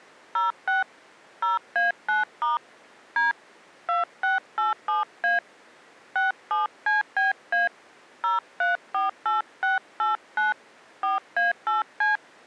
DTMF, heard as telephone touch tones, dialled by hand, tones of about 150 ms. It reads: 06 0A9* D 2687A 67CBA 0348689 4A8C